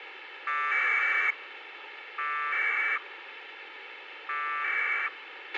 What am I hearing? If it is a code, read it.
Packet radio (AX.25, as in APRS), 1200 baud, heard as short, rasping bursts, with radio hiss and a squelch burst at the end.